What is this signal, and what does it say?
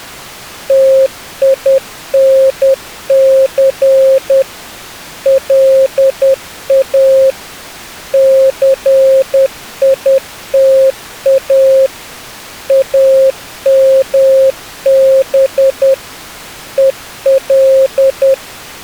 Morse code, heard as a keyed tone, machine-sent, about 10 wpm, 530 Hz. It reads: TINC LA CITA AMB EL